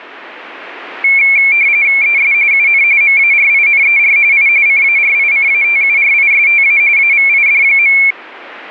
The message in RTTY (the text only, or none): ES UN MARINER I CARICATURISTA AVID.